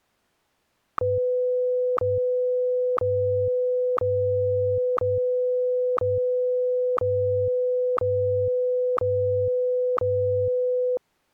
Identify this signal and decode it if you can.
Radio time signal (WWVH, Hawaii), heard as ticks, one a second.